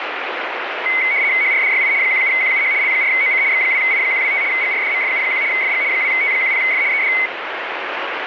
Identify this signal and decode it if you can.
RTTY (75 baud, 170 Hz shift), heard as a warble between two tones, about 2150 Hz centre, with radio static. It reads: HRDYI 17QUH L4OC X2I125 GRDMFU1 FG 2T10F ED